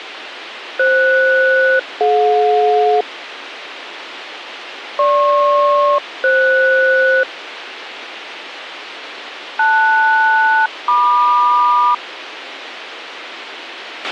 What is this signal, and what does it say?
Aircraft SELCAL, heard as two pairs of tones, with radio hiss and a squelch burst at the end. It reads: FS-DJ GP-FS LS-MQ